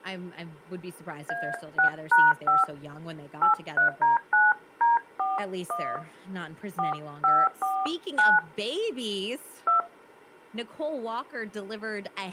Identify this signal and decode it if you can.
DTMF, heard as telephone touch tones, dialled by hand, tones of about 180 ms, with speech in English. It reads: A6#5 83D9D41 4549 2